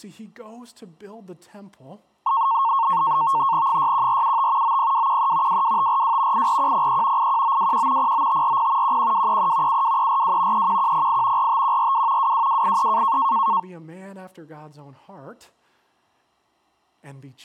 NAVTEX (SITOR-B), 100 baud, 170 Hz shift, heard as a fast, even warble, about 1000 Hz centre, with speech in English. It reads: 61475 90213 22542 84103 81921 09540 11233 72342 31108 45142 22283